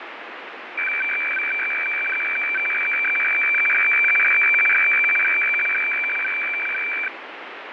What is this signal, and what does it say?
Weather fax (radiofax), 120 lines a minute, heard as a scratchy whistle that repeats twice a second, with radio static and fading.